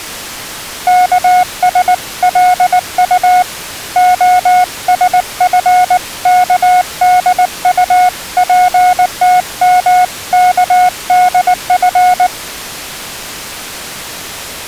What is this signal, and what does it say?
Morse code (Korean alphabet), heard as a keyed tone, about 19 wpm, 730 Hz. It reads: 여기 편의점은